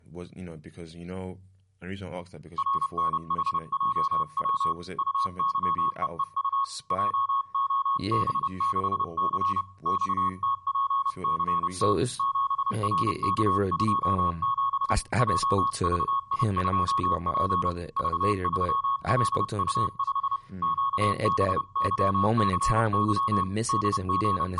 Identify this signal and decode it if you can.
Morse code, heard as a keyed tone, hand-sent with a paddle, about 30 wpm, 1100 Hz, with room echo and speech in English. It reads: RNHJW UYEEU JOB6C XTPCT 7RK27 JVI2P V3LU5 QBYCY …